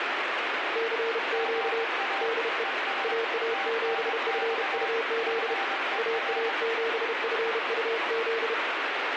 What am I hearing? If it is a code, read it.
Morse code, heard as two keyed tones, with radio static. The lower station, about 32 wpm, 460 Hz: CQ DE AA7FUZ AA7FUZ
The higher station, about 22 wpm, 780 Hz: GA ES TNX FER